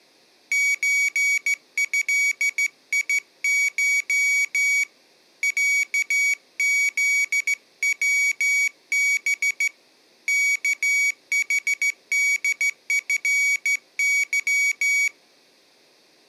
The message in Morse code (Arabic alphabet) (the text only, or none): زهيش عذوب كحدفظ